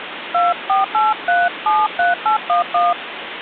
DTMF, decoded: 248373811

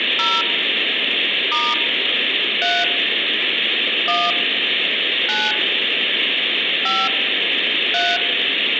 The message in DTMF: 0 * 3 1 9 5 3

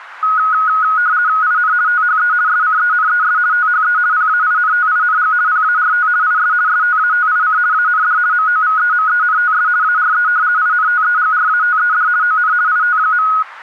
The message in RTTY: IN THE SCENES THE PAINTING PART IS STATIC AND MOVEMENTS ARE INTEGRATED ON IT.

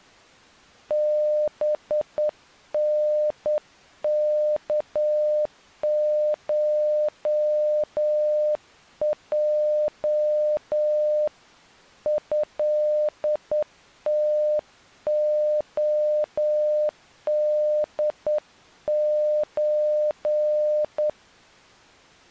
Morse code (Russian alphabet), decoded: БНКШЙ ЭТОДЧ

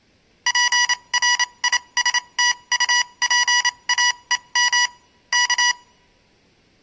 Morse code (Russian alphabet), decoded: ПРИСТУПАЕМ К

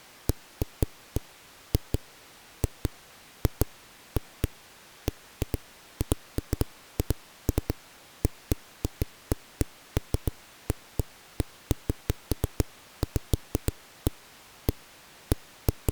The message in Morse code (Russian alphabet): none

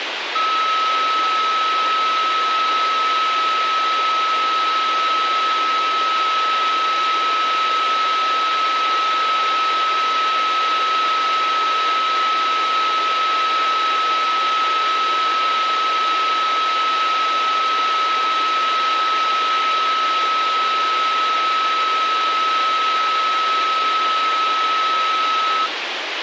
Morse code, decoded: none

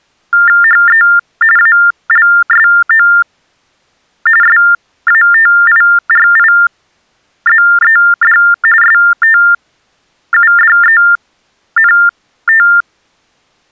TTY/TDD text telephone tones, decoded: HE ALSO SATIRIZED STUDENT

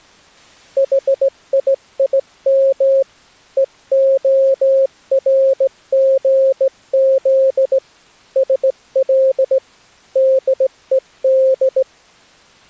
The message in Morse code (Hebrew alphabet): חיים והרגז של דוד

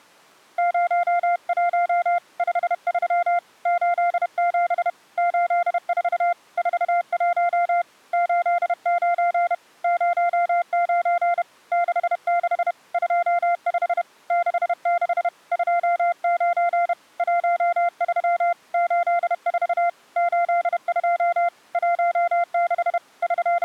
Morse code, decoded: 01 53 87 84 41 89 09 66 25 66 29 13 84 82 16 …

